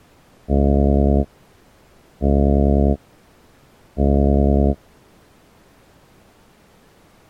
Ship horn signal, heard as a ship's horn, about 70 Hz. 3 short. At sea: I am operating astern propulsion.